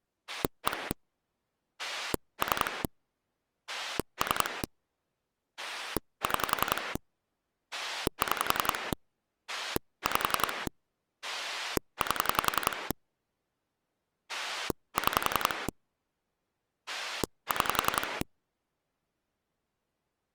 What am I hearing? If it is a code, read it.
Pulse dialling, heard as a rotary dial, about 11 pulses a second. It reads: 1 3 3 6 6 5 8 6 6